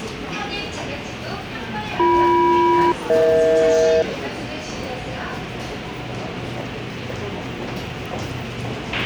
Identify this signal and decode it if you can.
Aircraft SELCAL, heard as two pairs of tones, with a squelch burst at the end and the noise of a subway station. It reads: BM-EH